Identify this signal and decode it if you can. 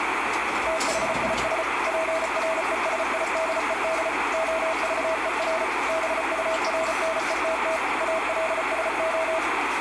Morse code, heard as a keyed tone, machine-sent, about 34 wpm, 650 Hz, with radio static and kitchen noise. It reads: THIS PRESIDED OVER BURNETT ALSO